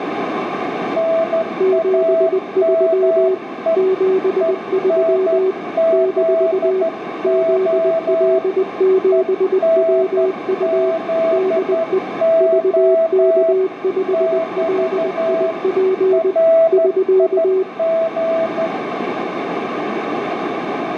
Morse code, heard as two keyed tones, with heavy radio static and a narrow filter. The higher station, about 12 wpm, 660 Hz: NAME ENZO ENZO <BT> RIG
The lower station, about 20 wpm, 380 Hz: 73 73 - ZL7WU DE VK5LIP <SK>